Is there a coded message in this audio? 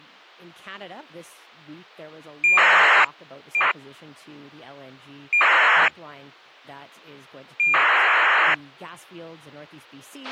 Yes: ACARS aircraft data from 2.4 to 8.5 s, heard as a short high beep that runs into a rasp, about 2400 baud, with a squelch burst at the end and speech in English.